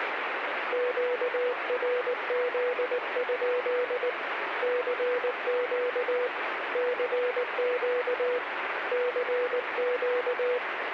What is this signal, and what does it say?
Morse code, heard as a keyed tone, hand-sent with a paddle, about 19 wpm, 490 Hz, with radio static. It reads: QRZ? CQ CQ CQ